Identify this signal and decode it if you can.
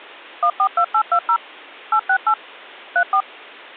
DTMF, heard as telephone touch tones, dialled by machine, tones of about 80 ms. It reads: 142820 868 34